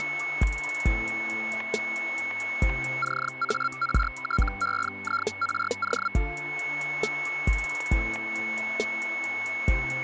Hellschreiber (Feld-Hell, 122.5 baud), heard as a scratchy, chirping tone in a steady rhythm, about 1380 Hz, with static crashes and a steady whistle near 2200 Hz. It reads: CARTEIRO